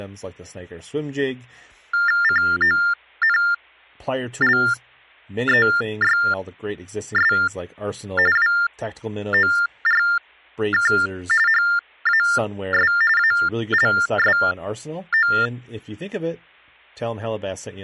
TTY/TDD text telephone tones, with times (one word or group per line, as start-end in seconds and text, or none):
2.2-7.3 CONLEYS
8.4-10.9 WORK
11.5-12.9 HAS
13.2-15.3 ALSO